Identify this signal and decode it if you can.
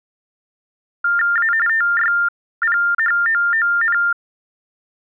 TTY/TDD text telephone tones (45.45 baud Baudot), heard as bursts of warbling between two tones, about 400 Hz shift, 1600 Hz centre. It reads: A TYPHOON